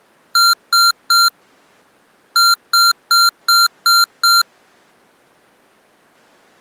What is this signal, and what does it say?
Beep code, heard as beeps from a small speaker, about 1380 Hz. 3-6.